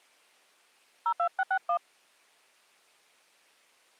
DTMF, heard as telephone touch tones, dialled by hand, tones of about 70 ms. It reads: 02661